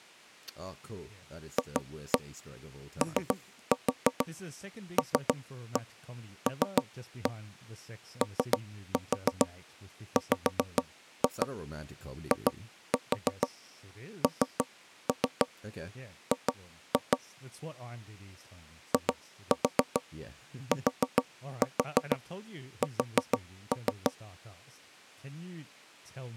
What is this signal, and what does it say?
Tap code, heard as knocks on wood, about 6 knocks a second, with speech in English. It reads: FOLLOWING ITS